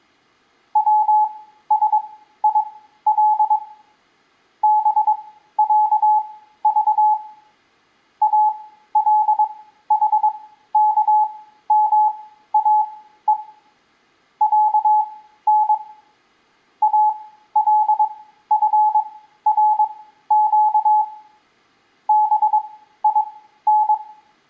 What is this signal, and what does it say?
Morse code (Arabic alphabet), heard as a keyed tone, machine-sent, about 22 wpm, spaced as for 13 wpm, 850 Hz, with room echo. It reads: وسيل بعض الحكماء عن الفرق بين